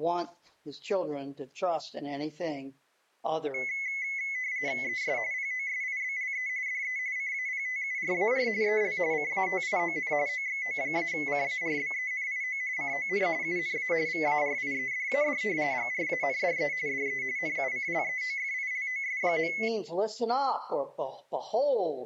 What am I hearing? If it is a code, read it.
RTTY (45.45 baud, 170 Hz shift), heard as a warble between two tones, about 2100 Hz centre. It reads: ES POSIBLE DE CAPTURAR EL CATION OXO-CARBENIO CON UNA VARIEDAD GRANDE DE NUCLEOFILOS.